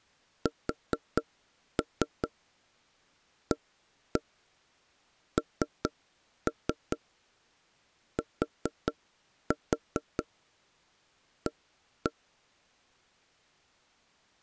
Tap code, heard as knocks on wood, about 4 knocks a second. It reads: SANTA